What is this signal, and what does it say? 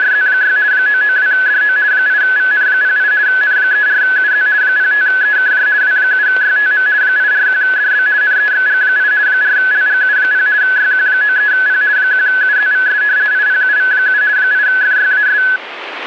RTTY (50 baud, 170 Hz shift), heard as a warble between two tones, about 1600 Hz centre, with radio static. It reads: … 992DO 8VN08 N34UZ 05EKJ W7YTM 841DB NEXG8 4LGU0 YQ93P 1UZVS IPUV7 8FYAS